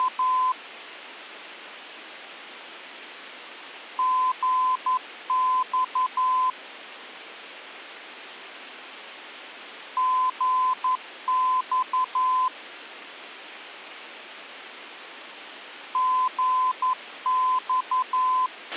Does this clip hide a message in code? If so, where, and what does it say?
Yes: Morse code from 0.0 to 18.5 s, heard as a keyed tone, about 11 wpm, 1020 Hz, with a squelch burst at the end. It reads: … GX GX GX